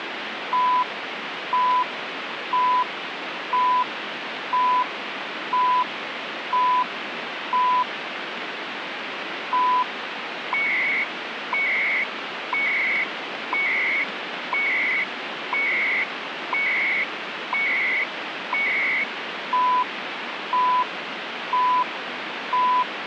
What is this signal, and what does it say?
Radio time signal (CHU, Canada), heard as beeps and data bursts, one a second, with radio static.